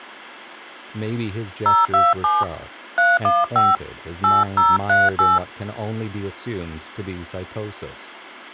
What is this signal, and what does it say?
DTMF, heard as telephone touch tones, dialled by hand, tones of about 190 ms, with speech in English. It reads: 027 315 8038